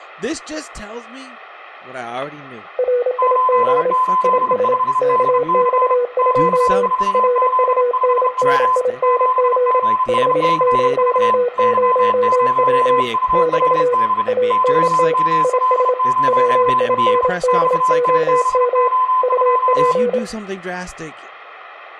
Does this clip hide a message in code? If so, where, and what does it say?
Yes: Morse code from 2.7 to 20.2 s, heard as two keyed tones, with room echo and speech in English. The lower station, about 27 wpm, 490 Hz: RIG IS KX2 RUNNING 500W <BT> ANT IS WINDOM UP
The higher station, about 31 wpm, 1020 Hz: 885DC Q4Z5W 7GSCV Y0URD YML0L XTBO2